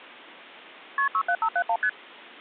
Multi-frequency trunk signalling (R1, as on North American trunks), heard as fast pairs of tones, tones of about 70 ms. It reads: KP 67571 ST